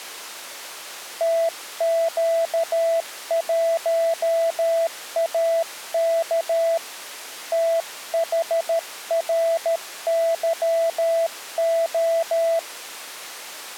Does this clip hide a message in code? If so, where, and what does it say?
Yes: Morse code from 1.1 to 12.7 s, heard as a keyed tone, hand-sent with a paddle, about 13 wpm, 660 Hz. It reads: TQ1AK THRYO